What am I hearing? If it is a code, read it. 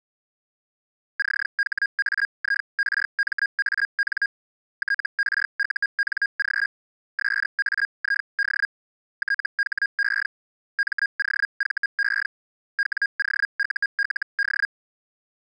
Hellschreiber (Feld-Hell, 122.5 baud), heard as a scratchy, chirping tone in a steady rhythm, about 1650 Hz. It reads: CHAIRMAN TRUNG SAID THE MOVE WOULD